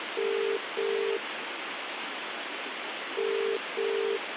Telephone call progress tone (as in the UK, Ireland, Australia and similar networks), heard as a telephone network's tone, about 400, 450 Hz, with phone line noise. Ringback tone.